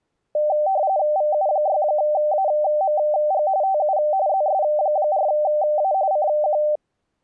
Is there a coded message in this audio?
Yes: RTTY (45.45 baud, 170 Hz shift) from 0.3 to 6.8 s, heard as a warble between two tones, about 690 Hz centre. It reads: VU6AMG TU ZS4A CQ